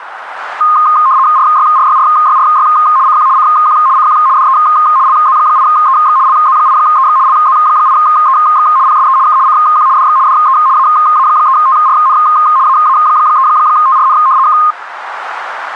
RTTY (75 baud, 170 Hz shift), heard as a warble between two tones, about 1150 Hz centre, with radio static. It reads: RYRYRYRY CQ CQ CQ DE LZ8EX LZ8EX LZ8EX PSE K CQ DX DE AA3TRN AA3TRN K